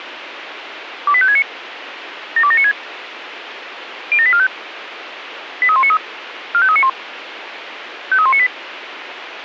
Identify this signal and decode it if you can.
Five-tone selective call (ZVEI), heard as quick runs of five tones, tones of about 70 ms, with radio hiss. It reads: 28569 72796 07845 83193 45391 53198